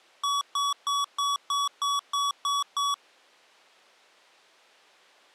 Beep code, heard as beeps from a small speaker, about 1130 Hz. 9 short. In AMI BIOS tables: ROM checksum failure.